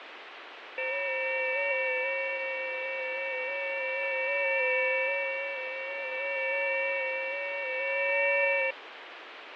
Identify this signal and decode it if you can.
FT8 (several signals at once), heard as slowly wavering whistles, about 6.25 baud, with radio static and fading.